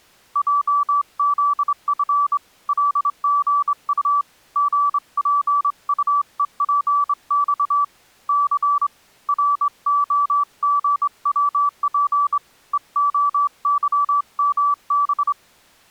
Morse code, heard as a keyed tone, hand-sent with a straight key, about 25 wpm, 1160 Hz. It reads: JZF LGU GPUEPX C ROGWP EOYMB